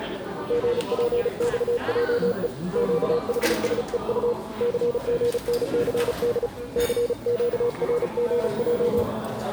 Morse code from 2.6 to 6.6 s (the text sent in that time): QHSEU CGNCD